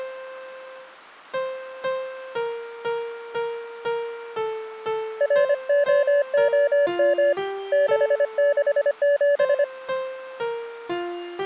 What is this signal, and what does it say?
Morse code, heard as a keyed tone, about 25 wpm, 570 Hz. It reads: ROOM 667